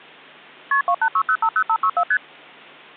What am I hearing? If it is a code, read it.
Multi-frequency trunk signalling (R1, as on North American trunks), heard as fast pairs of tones, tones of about 70 ms. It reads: KP 286050564 ST